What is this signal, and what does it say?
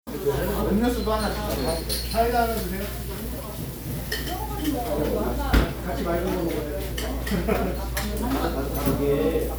The noise of a crowd indoors. There is no code.